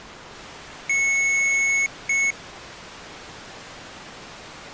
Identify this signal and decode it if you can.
Beep code, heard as beeps from a small speaker, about 2200 Hz. 1 long, 1 short. In IBM BIOS tables: system board problem.